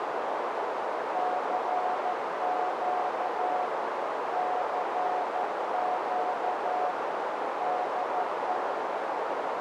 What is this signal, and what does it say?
Morse code, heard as a keyed tone, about 13 wpm, 730 Hz, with heavy radio static and a narrow filter. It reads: CQ CQ DE